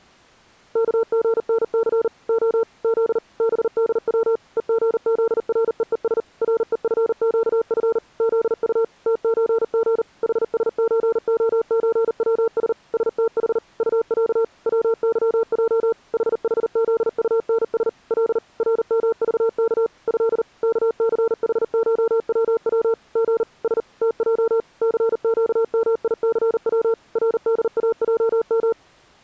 Morse code (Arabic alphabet), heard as a keyed tone, machine-sent, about 39 wpm, 450 Hz. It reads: كغنث خ ذ بدو ءغذرءءس رءفقف ذط تزغ حسزخزوس ستح طع وظج ححذطنس ل رمضك ه كثحشوو غ س تج ثقميثو رداجم